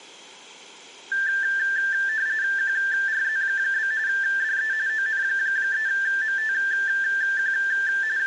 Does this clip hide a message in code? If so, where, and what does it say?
Yes: RTTY (45.45 baud, 170 Hz shift) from 1.1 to 8.3 s, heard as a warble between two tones, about 1650 Hz centre, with room echo. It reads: QRZ? DE ON3MTQ …